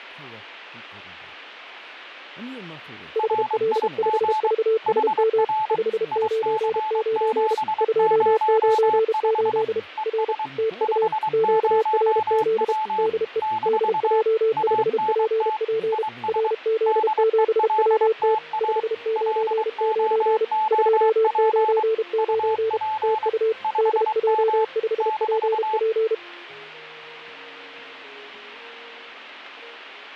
Morse code, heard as two keyed tones. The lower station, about 32 wpm, 440 Hz: HL5VSM 599 298 R TU QRZ DE DJ5PP RZ7WT 599 299 TU DJ5PP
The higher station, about 23 wpm, 870 Hz: RIG HR IC705 ES 50W - ANT IS DELTA LOOP UP 5M -